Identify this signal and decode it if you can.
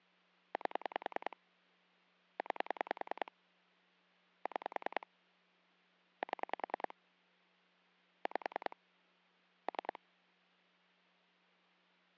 Pulse dialling, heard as clicks on a phone line, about 10 pulses a second. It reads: 8 9 6 7 5 3